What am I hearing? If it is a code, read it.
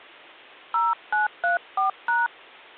DTMF, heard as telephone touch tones, dialled by hand, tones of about 180 ms. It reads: 0934#